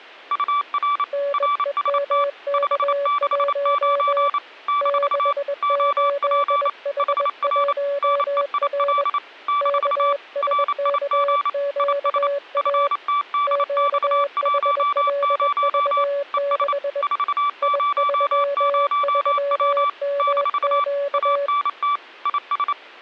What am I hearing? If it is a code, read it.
Morse code, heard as two keyed tones. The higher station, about 28 wpm, 1160 Hz: UR RST 569 - OP HR NEIL - RIG IS FTDX10 ES 400W - ANT IS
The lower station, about 21 wpm, 570 Hz: NEMK1 68H1R KSKQA QHLV6 I33MQ